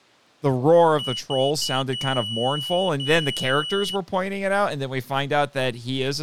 Beep code, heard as a piezo beeper, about 2950 Hz, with speech in English. 3 short, 2 long.